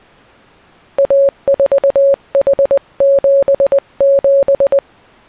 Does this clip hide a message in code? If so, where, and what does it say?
Yes: Morse code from 0.9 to 4.8 s, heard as a keyed tone, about 20 wpm, 550 Hz. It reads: A4H77